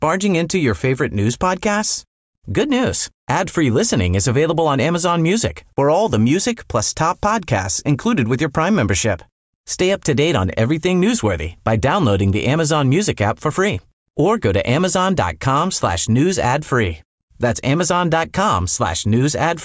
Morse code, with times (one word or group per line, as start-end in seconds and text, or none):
none